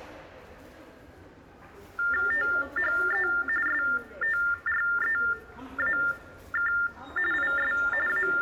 TTY/TDD text telephone tones (45.45 baud Baudot), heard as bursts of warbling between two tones, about 400 Hz shift, 1600 Hz centre, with the noise of a subway station. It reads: THE STREAK IS …